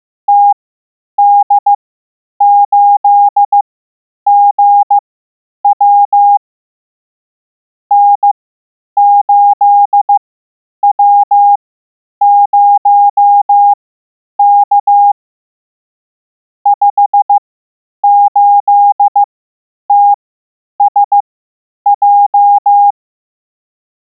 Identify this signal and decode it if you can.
Morse code, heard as a keyed tone, machine-sent, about 15 wpm, spaced as for 9 wpm, 810 Hz. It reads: TD8GW N8W0K 58TSJ